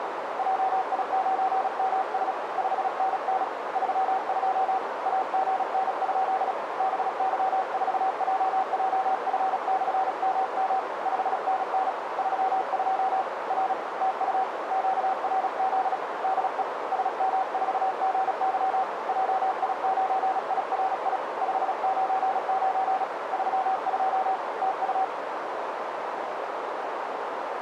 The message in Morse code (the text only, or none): JI9MS 5NN 32 AGN? BY4JJF/MM 5NN 32 R TU QRZ DE SM4GY JI9IRI 599 32 TU